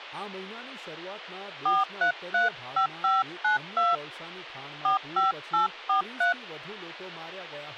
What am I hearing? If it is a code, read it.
DTMF, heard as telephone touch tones, dialled by hand, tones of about 140 ms, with speech in Gujarati. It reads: 4335592 45843